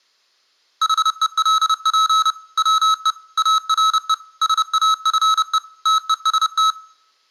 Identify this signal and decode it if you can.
Morse code, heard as electronic beeps, machine-sent, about 30 wpm, 1290 Hz, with room echo. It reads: HELP WE ARE SAFE TEST